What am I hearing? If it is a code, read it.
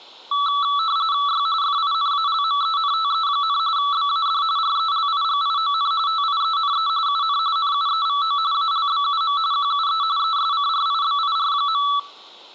RTTY (45.45 baud, 170 Hz shift), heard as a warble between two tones, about 1230 Hz centre, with room echo. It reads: Y FINALMENTE, BAD RELIGION TIENE UN NUEVO ALBUM QUE ESCRIBIR.